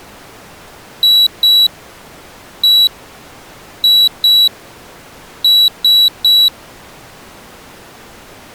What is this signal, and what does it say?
Beep code, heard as a piezo beeper, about 3900 Hz. 2-1-2-3. In Phoenix BIOS tables: ROM copyright notice check failure.